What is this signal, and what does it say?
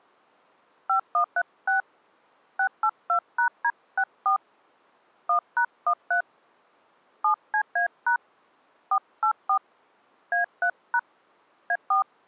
DTMF, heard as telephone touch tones, dialled by hand, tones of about 100 ms. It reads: 5136 682#D64 1#13 7CA# 484 A3# A4